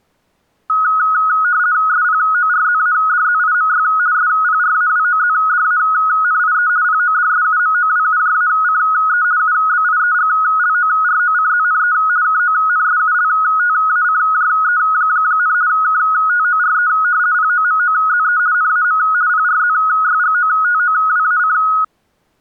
RTTY (50 baud, 170 Hz shift), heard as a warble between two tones, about 1360 Hz centre. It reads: SPORZADZIMY SPRAWOZDANIE PODSUMOWUJACE UBIEGLOROCZNE KONSULTACJE, KTORE POMOZE NAM PRZYGOTOWAC